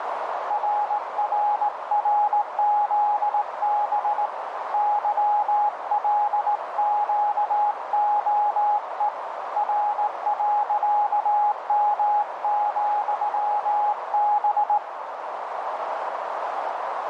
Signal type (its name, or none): Morse code